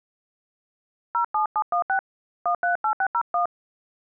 DTMF, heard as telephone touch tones, dialled by hand, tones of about 90 ms. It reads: 07716 138601